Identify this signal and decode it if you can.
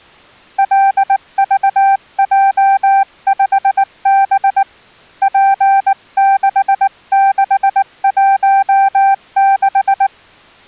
Morse code, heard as a keyed tone, hand-sent with a paddle, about 19 wpm, 780 Hz. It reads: LVJ5B P6616